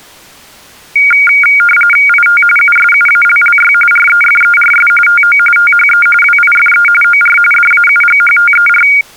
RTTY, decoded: IT USUALLY REFERS TO THE WIFE OR DAUGHTER

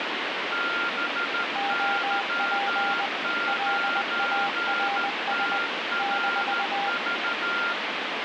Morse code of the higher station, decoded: BY9TRV

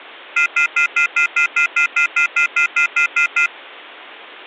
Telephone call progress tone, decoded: off-hook warning tone

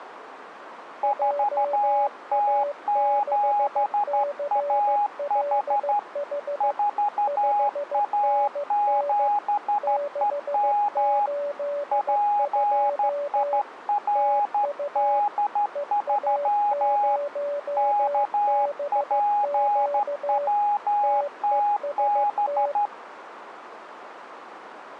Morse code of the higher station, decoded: 4T7AH 4A7EM PIRD3 KPWTB

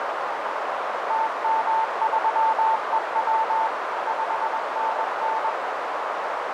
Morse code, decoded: TM3EW 5NN

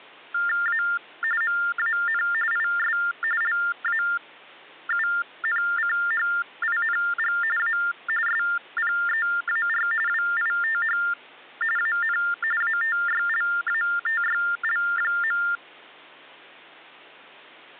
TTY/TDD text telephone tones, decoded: A MAN IS LAUNCHING A SPEAR WITH AN ATYLATYL.

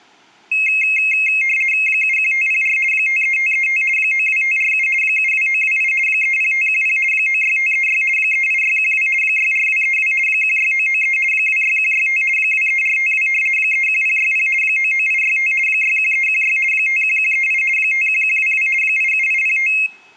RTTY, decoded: 71504 53535 92547 72928 30510 96536 38612 64232 16993 26165 23452 31060 99865 61316 51138 51122 87805

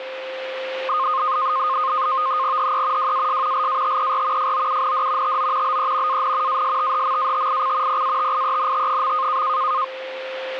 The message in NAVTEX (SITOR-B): HE WAS LATER FOUND TO BE AN ASTHMATIC PATIENT.

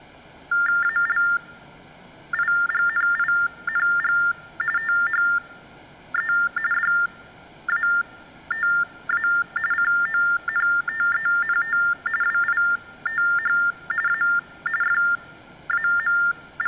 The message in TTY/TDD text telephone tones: ALIGNING THE DATA CONTENT WITH A …

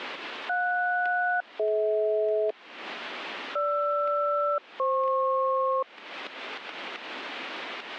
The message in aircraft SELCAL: JS-DH GR-FP

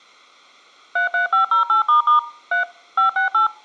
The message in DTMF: 33508** 3 568

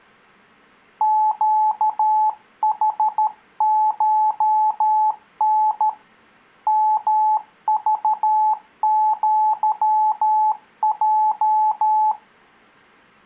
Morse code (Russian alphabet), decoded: ЩХШН МЖЪЙ

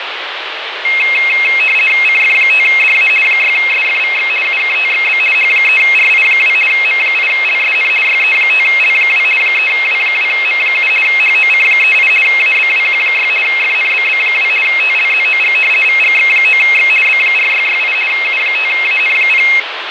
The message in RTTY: CF5DA 6SFVX UKTXB H3RI2 M8LSN YE5L2 3W2M7 HOC38 ABWQ6 FNBB2 TLZOG VGX9X B4668 U5AN0

